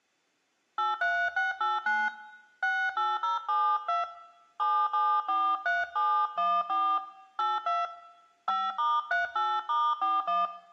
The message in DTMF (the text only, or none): 83689 68072 7743714 82 5*38*41